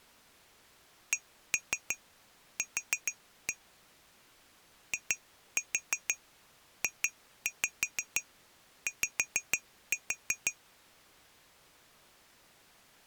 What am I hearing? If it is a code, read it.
Tap code, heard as taps on glass, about 6 knocks a second. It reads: CQ IJY